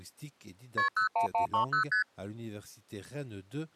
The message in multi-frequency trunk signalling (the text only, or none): KP 01130 ST